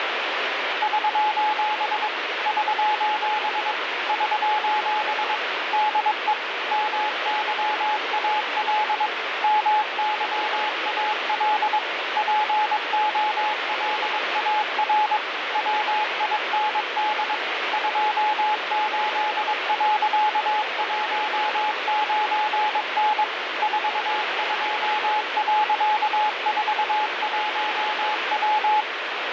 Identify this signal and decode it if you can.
Morse code, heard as a keyed tone, machine-sent, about 22 wpm, 850 Hz, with heavy radio static. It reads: <SOS> <SOS> <SOS> DE MYAL MYAL POLAR WIND 28.19N 42.41W